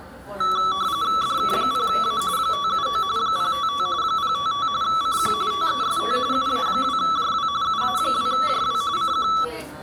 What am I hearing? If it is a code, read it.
RTTY (45.45 baud, 170 Hz shift), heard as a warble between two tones, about 1230 Hz centre, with the noise of a cafe. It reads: DK0A 579 055 055 CQ TEST UA2JW UA2JW CQ